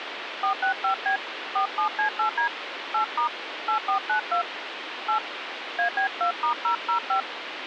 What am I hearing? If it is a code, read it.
DTMF, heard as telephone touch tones, dialled by hand, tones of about 100 ms, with phone line noise. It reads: 465B 47C8D 8* 8492 8 AB2*005